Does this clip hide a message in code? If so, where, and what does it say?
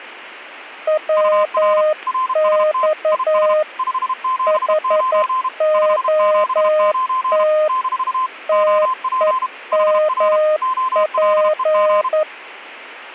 Yes: Morse code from 0.8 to 12.3 s, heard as two keyed tones. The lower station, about 11 wpm, 620 Hz: WX HOT TEMP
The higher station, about 32 wpm, 1040 Hz: UR RST IS 579 579 - OP HR OLEG